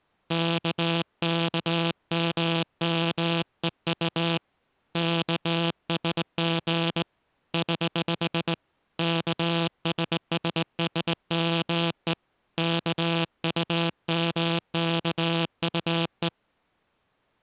Morse code, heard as a buzzer, hand-sent with a straight key, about 19 wpm. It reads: KKMMEU KSG <HH> KSSSME KUMKUE